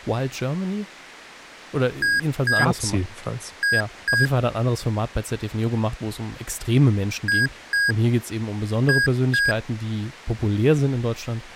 Beep code, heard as beeps from a small speaker, played twice, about 1650 Hz, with speech in German. 2-2.